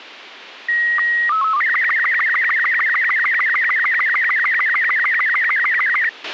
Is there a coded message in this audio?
Yes: SSTV (slow-scan television), Robot 36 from 0.7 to 6.1 s, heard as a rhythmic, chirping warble, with radio hiss and a squelch burst at the end.